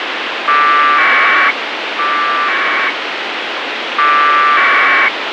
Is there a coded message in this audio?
Yes: packet radio (AX.25, as in APRS), 1200 baud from 0.5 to 5.1 s, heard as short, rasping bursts, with radio hiss and a squelch burst at the end.